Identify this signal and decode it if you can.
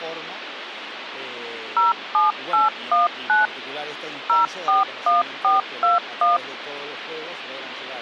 DTMF, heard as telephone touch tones, dialled by machine, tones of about 160 ms, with phone line noise. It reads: 07819 041421